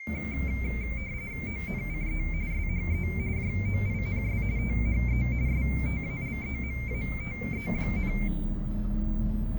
RTTY (45.45 baud, 170 Hz shift), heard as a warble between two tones, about 2200 Hz centre, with the noise inside a bus. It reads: ONCE SHE JOINS THE STALEMATE,